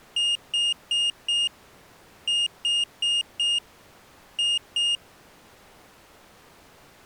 Beep code, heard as a piezo beeper, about 2850 Hz. 4-4-2. In Phoenix BIOS tables: parallel port failure.